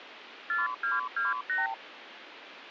Multi-frequency trunk signalling (R2, with the far end's replies), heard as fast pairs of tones, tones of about 170 ms, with phone line noise. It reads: 4228